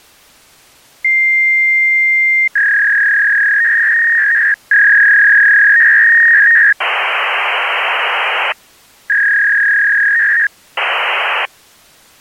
Fax machine handshake, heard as a long tone, a warble and hiss.